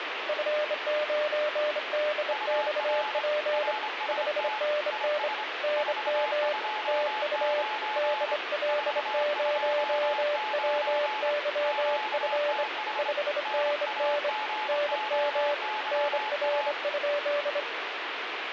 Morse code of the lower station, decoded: F9DXP 5NN NM TU DL0WYF 5NN NM NR?

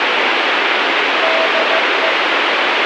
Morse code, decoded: DE

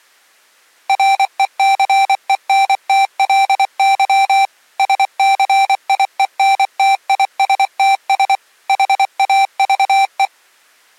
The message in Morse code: RECENTLY SCIENTISTS HAVE

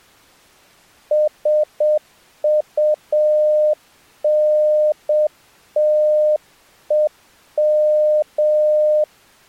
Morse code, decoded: SUNTEM

